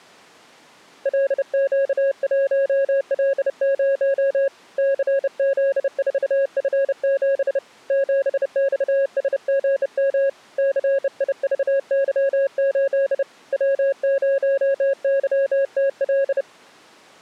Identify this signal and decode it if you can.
Morse code, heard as a keyed tone, hand-sent with a bug key, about 30 wpm, 550 Hz. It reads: LQ1L0 CZ4F7 7XSGM CIVY8 W0YTL